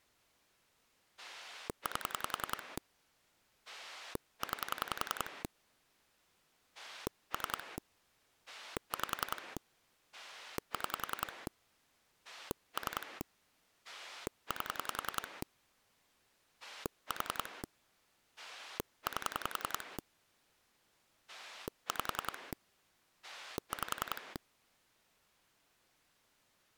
Pulse dialling, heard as a rotary dial, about 10 pulses a second. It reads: 8 9 3 5 6 3 8 4 8 5 5